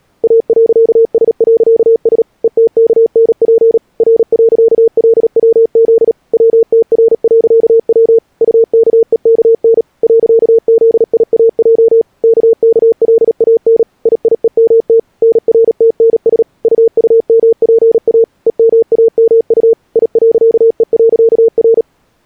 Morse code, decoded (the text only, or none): A.S.S ETKNP R.LWZ WTR.W UKEKN .ZIAJ KKLAN IIEMT NRTNS UUMPA EMAMU I.E.R